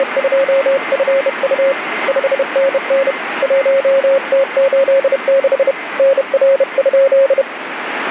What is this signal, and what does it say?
Morse code, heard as a keyed tone, hand-sent with a bug key, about 31 wpm, 540 Hz, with radio static and a weaker station near 2070 Hz. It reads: … 5NN 1T86 NR?